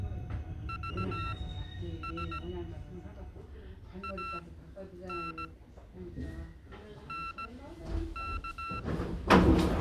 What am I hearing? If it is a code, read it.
Morse code, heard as electronic beeps, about 17 wpm, spaced as for 9 wpm, 1340 Hz, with the noise inside a subway train. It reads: VS AN NK